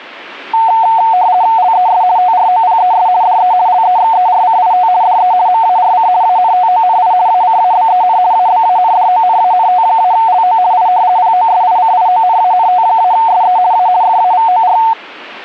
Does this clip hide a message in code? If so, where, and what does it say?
Yes: RTTY (50 baud, 170 Hz shift) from 0.5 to 14.9 s, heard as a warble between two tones, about 810 Hz centre. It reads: LES TROPES DE LEXERCIT DE MARC ANTONI ACABEN ABANDONANT-LO I POSICIONANT-SE A FAVOR